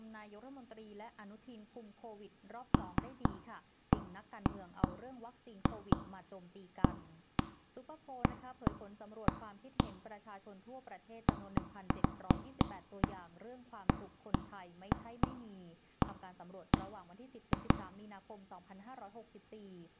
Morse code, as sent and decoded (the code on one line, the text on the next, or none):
none